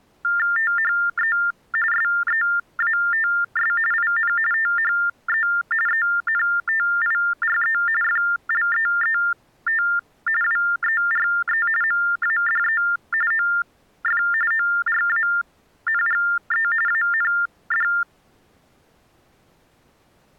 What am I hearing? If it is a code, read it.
TTY/TDD text telephone tones (45.45 baud Baudot), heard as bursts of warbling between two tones, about 400 Hz shift, 1600 Hz centre. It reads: THE SEATS IN THE ENTIRE FLEET WERE MADE OF ORANGE AND